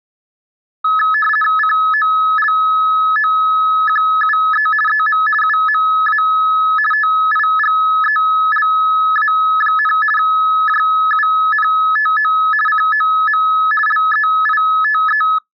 RTTY (50 baud, 450 Hz shift), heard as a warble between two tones, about 1500 Hz centre. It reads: COLOQUE EM UMA TIGELA, JUNTO COM LEITE